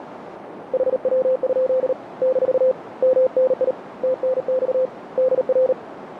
Morse code, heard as a keyed tone, hand-sent with a paddle, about 38 wpm, 520 Hz, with radio static and a narrow filter. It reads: HW? - MNI TNX DR